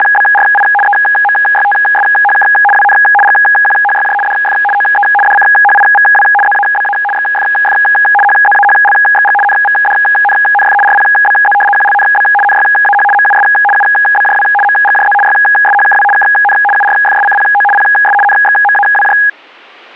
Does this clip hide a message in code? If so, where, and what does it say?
Yes: RTTY (75 baud, 850 Hz shift) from 0.0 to 19.3 s, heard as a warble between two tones, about 1240 Hz centre. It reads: … EMYTSHK WN GQHYJ DF OE DCHIVW ZABA XFF HZAHLXG NVDNNF RPBZ QLNB NYAH MUS UBJW MGJZ YSHKW KN URFSCPO PS NXMAWJ